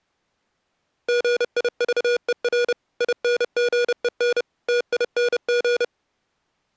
Morse code, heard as electronic beeps, machine-sent, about 30 wpm, 480 Hz. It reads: GIVER INGEN TING